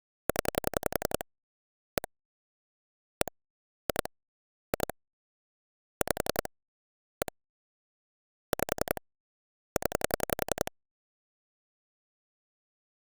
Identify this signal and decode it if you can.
Pulse dialling, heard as clicks on a phone line, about 11 pulses a second. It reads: 0 1 1 2 2 5 1 5 0